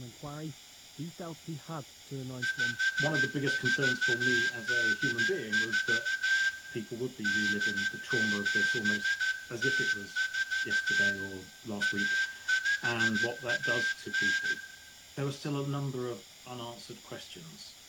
Morse code (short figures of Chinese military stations), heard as a whistle, hand-sent with a straight key, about 14 wpm, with room echo. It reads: 5484 8704 1519